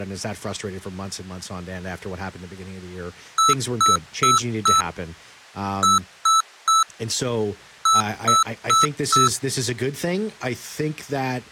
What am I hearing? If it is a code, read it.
Beep code, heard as beeps from a small speaker, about 1310 Hz, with speech in English. 4-3-4. In Phoenix BIOS tables: time-of-day clock failure.